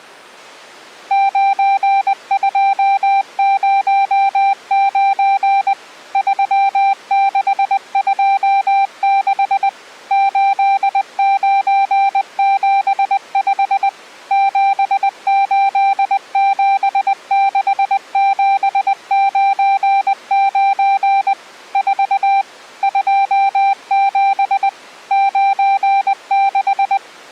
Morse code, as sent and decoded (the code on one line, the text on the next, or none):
----. ..--- ----- ----. / ...-- -.... ..--- -.... / ---.. ----. --... ..... / --... ---.. --... -.... --... ----. ----. / ....- / ..--- --... / ----. -....
9209 3626 8975 7876799 4 27 96